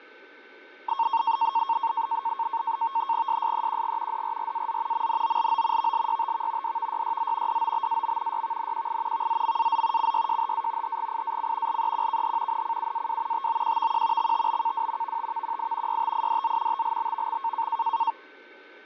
NAVTEX (SITOR-B), 100 baud, 170 Hz shift, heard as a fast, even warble, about 1000 Hz centre, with fading and a steady whistle near 1530 Hz. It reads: SSEQG DRRAZ MNOLO VLYTV DVYYZ DOBAM YVNQI VZMAZ CYJHA HGIAC LEQKH NCUAW TOQVQ XTBKW VTVQI YTIDZ TLBVX